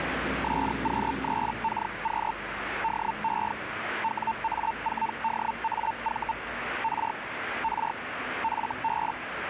Hellschreiber (Feld-Hell, 122.5 baud), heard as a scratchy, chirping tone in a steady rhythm, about 900 Hz, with radio static and street noise. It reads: SQ3KQ DE WA4DAV R R FB